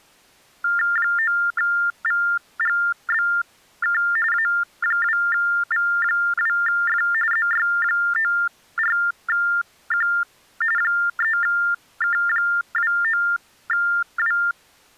TTY/TDD text telephone tones (45.45 baud Baudot), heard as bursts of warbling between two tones, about 400 Hz shift, 1600 Hz centre. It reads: 9VGBK A2V2F ZY94Q 3K29W